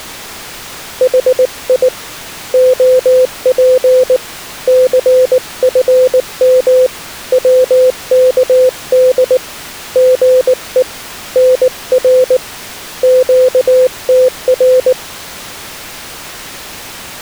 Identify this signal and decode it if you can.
Morse code, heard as a keyed tone, hand-sent with a paddle, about 19 wpm, 510 Hz. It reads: HI OP CFM WKD GE NR QTR